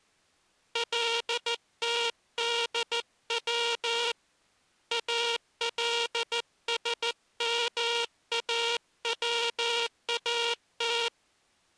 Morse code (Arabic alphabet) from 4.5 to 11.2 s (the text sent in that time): السماوات